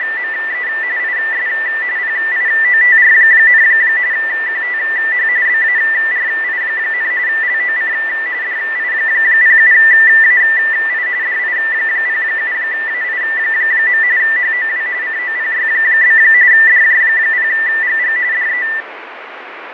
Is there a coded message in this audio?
Yes: RTTY (45.45 baud, 170 Hz shift) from 0.0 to 18.8 s, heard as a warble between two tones, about 1900 Hz centre, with radio static and fading. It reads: … IS PIOTR, QTH BARI, LOC DI07AI DI07AI. HOW COPY? DJ0GG DE